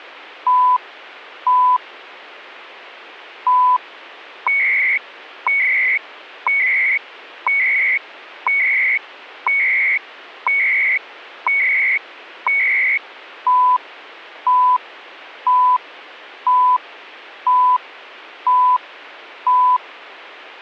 Radio time signal (CHU, Canada), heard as beeps and data bursts, one a second.